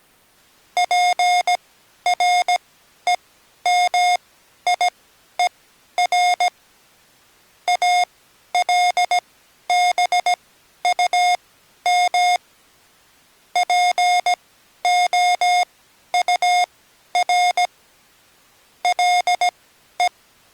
Morse code, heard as electronic beeps, machine-sent, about 17 wpm, spaced as for 11 wpm, 720 Hz. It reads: PREMIER ALBUM POUR LE